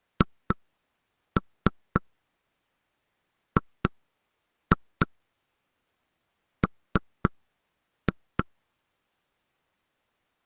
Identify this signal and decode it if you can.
Tap code, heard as knocks on wood, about 3 knocks a second. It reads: HGM